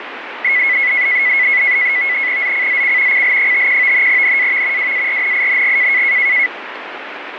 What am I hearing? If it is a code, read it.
NAVTEX (SITOR-B), 100 baud, 170 Hz shift, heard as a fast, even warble, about 2100 Hz centre, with radio static. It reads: ZCZC CL51 NAV WARNING